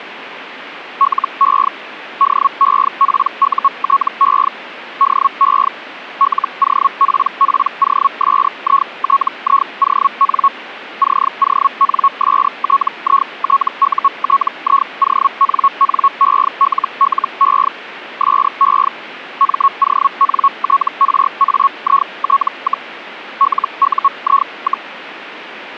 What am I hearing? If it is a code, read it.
Hellschreiber (Feld-Hell, 122.5 baud), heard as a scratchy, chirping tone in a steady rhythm, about 1100 Hz. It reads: LE DEPUTE DE LOPPOSITION CONSTITUTIONNELLE SE MONTRAIT, LUI,